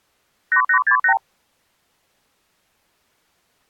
Multi-frequency trunk signalling (R2, with the far end's replies), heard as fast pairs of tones, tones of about 90 ms. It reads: 8868